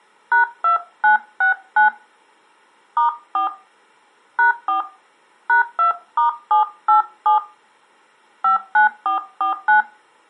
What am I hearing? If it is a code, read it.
DTMF, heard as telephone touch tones, dialled by hand, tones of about 120 ms. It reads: #2969 *4 #4 #2*787 59449